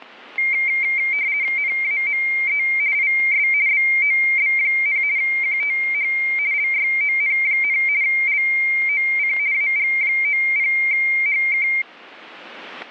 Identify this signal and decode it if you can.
RTTY (50 baud, 170 Hz shift), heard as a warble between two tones, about 2200 Hz centre, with static crashes. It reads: NAME IS BOB, QTH LYON, LOC AG90HK